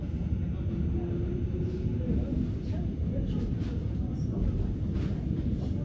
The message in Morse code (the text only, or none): none